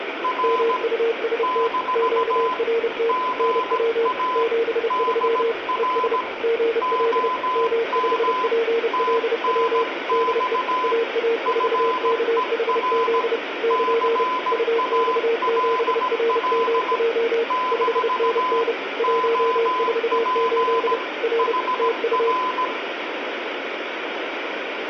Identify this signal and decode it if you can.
Morse code, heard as two keyed tones, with radio static and room echo. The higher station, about 17 wpm, 1010 Hz: R - GA DR OM TNX FER CALL - OP HR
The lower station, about 30 wpm, 460 Hz: MUST QRT NW 73 ES GL M5PLW DE AA4KHZ <KN> UX7RMJ 5NN 148 R TU